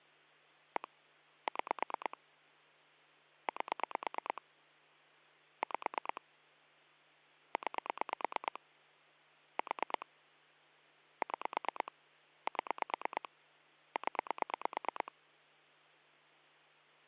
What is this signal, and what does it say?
Pulse dialling, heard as clicks on a phone line, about 9 pulses a second, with hum. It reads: 1 6 8 5 9 4 6 7 0